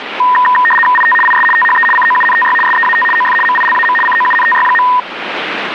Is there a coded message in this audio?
Yes: RTTY (75 baud, 850 Hz shift) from 0.2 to 5.0 s, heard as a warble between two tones, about 1420 Hz centre, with radio static. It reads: IT IS THE COUNTY SEAT OF MILAM COUNTY.